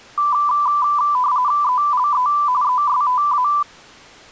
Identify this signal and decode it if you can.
RTTY (45.45 baud, 170 Hz shift), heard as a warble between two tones, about 1090 Hz centre. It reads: ELE ESTA